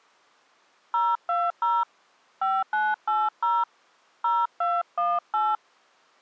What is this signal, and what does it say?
DTMF, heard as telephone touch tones, dialled by hand, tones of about 210 ms. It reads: 020 5980 0218